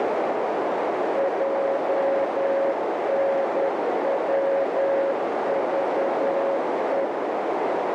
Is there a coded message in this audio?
Yes: Morse code (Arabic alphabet) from 1.1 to 7.1 s, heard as a keyed tone, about 10 wpm, 550 Hz, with heavy radio static and a narrow filter. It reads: جنوضء